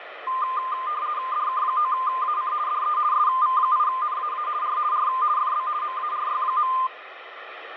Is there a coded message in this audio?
Yes: RTTY (50 baud, 170 Hz shift) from 0.3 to 6.9 s, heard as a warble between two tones, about 1120 Hz centre, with radio static. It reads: DK9AC DE SV8NAA R R FB MARY.